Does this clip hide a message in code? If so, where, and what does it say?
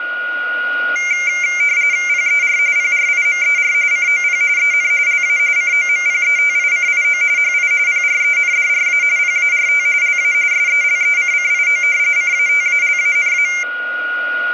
Yes: RTTY (45.45 baud, 170 Hz shift) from 1.0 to 13.6 s, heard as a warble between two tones, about 2200 Hz centre, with a steady whistle near 1440 Hz. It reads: PER PRIMER COP EN LA COMPETICIO HI PRENDRA PART LA SELECCIO CATALANA